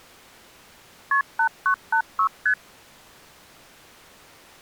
Multi-frequency trunk signalling (R1, as on North American trunks), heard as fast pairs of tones, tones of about 80 ms. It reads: KP 8986 ST